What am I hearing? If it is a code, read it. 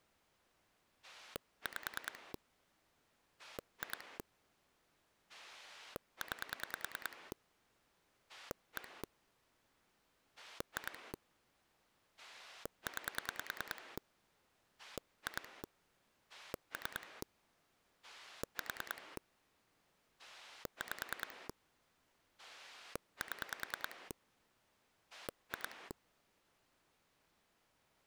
Pulse dialling, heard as a rotary dial, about 10 pulses a second. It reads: 5 2 9 1 2 9 2 3 4 5 7 2